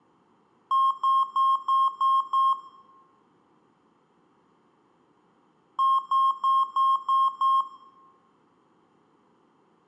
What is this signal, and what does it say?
Beep code, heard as beeps from a small speaker, played twice, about 1070 Hz, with room echo. 6 short. In AMI BIOS tables: keyboard controller gate A20 failure; in Dell tables: video card failure.